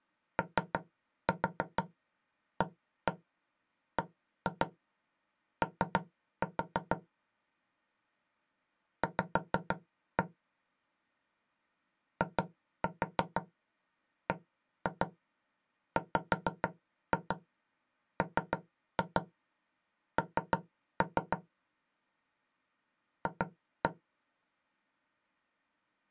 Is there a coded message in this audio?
Yes: tap code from 0.4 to 23.9 s, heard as knocks on wood, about 6 knocks a second. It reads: OABO V IBWMN F